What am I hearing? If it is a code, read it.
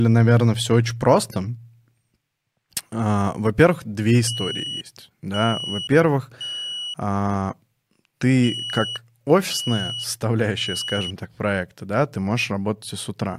Alarm pattern, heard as an alarm's beeps, played twice, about 2950 Hz, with speech in Russian. Temporal three. Smoke or fire, evacuate.